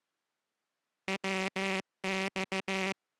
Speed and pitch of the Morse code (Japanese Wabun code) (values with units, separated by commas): 15 wpm